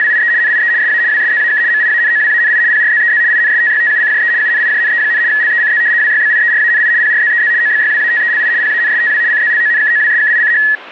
RTTY (75 baud, 170 Hz shift), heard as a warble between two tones, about 1800 Hz centre, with radio static. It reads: … NIE SA WSZAK MIANOWANI PRZEZ INSTYTUCJE UNIJNE, LECZ WYBIERANI PRZEZ OBYWATELI PANSTW CZLONKOWSKICH